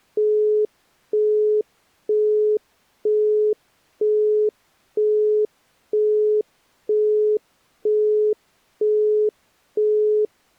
Telephone call progress tone (single-tone plan, as in Europe, Japan and elsewhere), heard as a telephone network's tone, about 420 Hz, 0.48 s on and 0.48 s off. Busy tone.